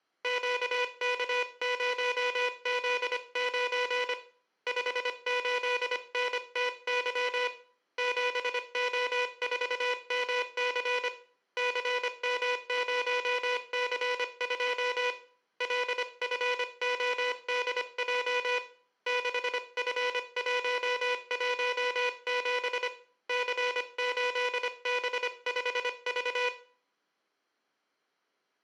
Morse code, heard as a buzzer, hand-sent with a paddle, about 25 wpm, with room echo. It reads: QK0Z9 58NTY 7O4MC CM0C2 LFODJ 6F117 C8B5V